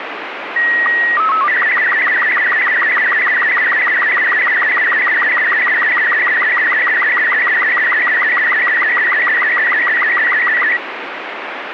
SSTV (slow-scan television), Robot 36, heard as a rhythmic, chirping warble, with radio static.